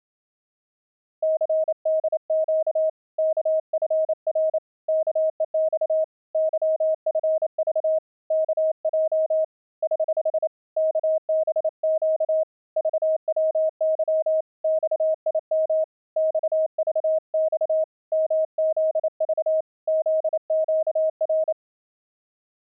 Morse code, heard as a keyed tone, hand-sent with a paddle, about 28 wpm, 630 Hz. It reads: CDQ KFR KEX YFV KJ <HH> KBQ VWY XIM XVX MZV ZQR